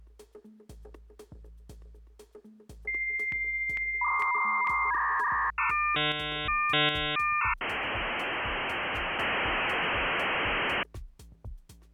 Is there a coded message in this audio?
Yes: dial-up modem handshake (V.34 or later) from 2.9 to 10.8 s, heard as a whistle, warbles, then hiss.